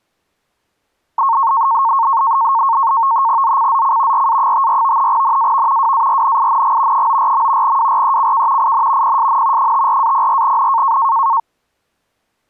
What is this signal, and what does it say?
NAVTEX (SITOR-B), 100 baud, 170 Hz shift, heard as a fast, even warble, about 1000 Hz centre. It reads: ZCZC RA54 NAV WARNING 94. WRECK IN PSN 54-04N